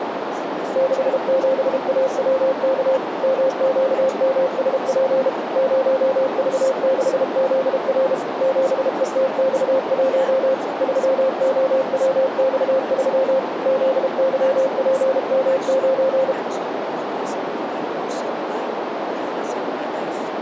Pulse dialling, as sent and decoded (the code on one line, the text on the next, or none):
none